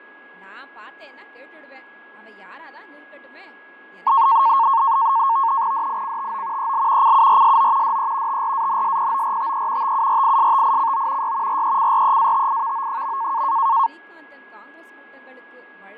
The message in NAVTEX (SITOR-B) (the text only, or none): DICTO EL CURSO DE TRANSPORTE TURISTICO Y RECREATIVO.